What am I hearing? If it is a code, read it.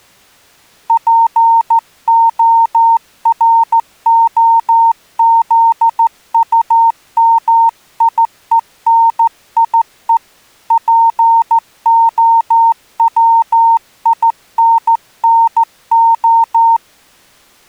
Morse code, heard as a keyed tone, hand-sent with a straight key, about 14 wpm, 920 Hz. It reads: POROZUMIENIE POWINNO